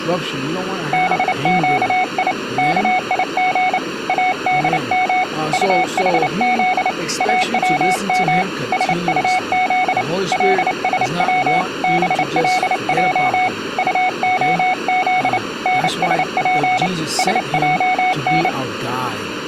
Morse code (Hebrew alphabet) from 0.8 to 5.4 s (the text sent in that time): בקי כיג אדם